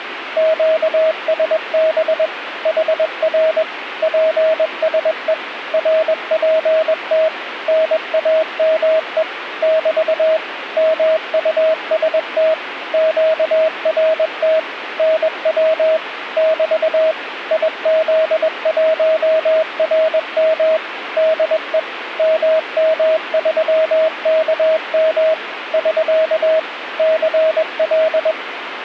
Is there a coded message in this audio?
Yes: Morse code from 0.3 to 28.4 s, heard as a keyed tone, machine-sent, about 21 wpm, 640 Hz, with radio static. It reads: QSB HR PSE RPT NAME <BT> MUST QRT NW <BT> IZ1RM DE MM3KM <SK> CL